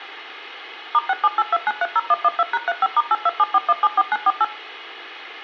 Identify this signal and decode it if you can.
DTMF, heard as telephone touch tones, dialled by machine, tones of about 40 ms, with room echo. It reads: *6782930112#35*8274174948